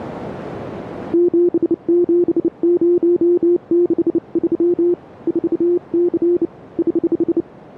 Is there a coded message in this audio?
Yes: Morse code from 1.1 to 7.5 s, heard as a keyed tone, hand-sent with a bug key, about 29 wpm, 350 Hz, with radio static. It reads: 77063 4C <HH>